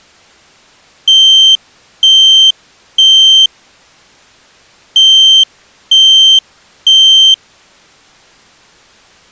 Alarm pattern, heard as an alarm's beeps, played twice, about 3150 Hz. Temporal three. Smoke or fire, evacuate.